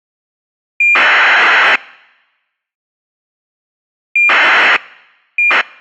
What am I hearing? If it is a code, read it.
ACARS aircraft data, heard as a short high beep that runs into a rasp, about 2400 baud.